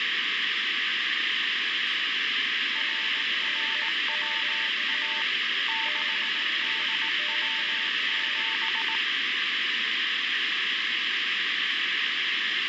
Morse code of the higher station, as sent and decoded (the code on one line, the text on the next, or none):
.-. .-. .-- .- / -.... -.. .-- --...
RRWA 6DW7